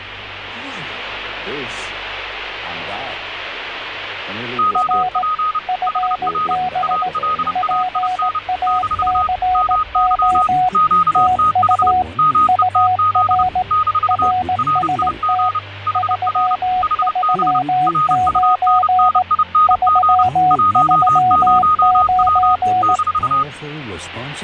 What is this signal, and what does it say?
Morse code, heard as two keyed tones, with radio static. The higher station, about 30 wpm, 1250 Hz: OP HR ALAIN - MY QTH METZ - RIG HR HB RUNNING 10W -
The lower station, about 18 wpm, 740 Hz: R FB PACO TU UR RST 339 339